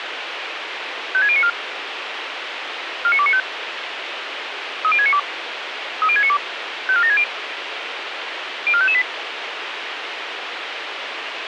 Five-tone selective call (ZVEI), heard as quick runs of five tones, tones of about 70 ms, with radio hiss and a squelch burst at the end. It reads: 56094 49295 30692 30692 54760 04558